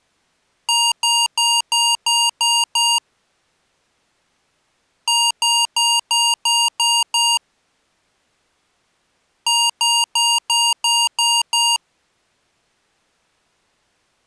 Beep code, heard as beeps from a small speaker, played three times, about 940 Hz. 7 short. In AMI BIOS tables: virtual mode exception error; in Dell tables: processor failure.